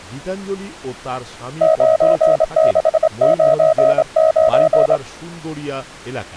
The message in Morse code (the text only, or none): 9699